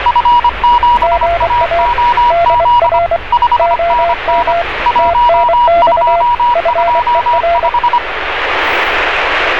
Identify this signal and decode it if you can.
Morse code, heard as two keyed tones, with radio static and street noise. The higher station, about 25 wpm, 960 Hz: F7AOZ 5NN 1225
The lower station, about 24 wpm, 680 Hz: GA DR OM TNX FER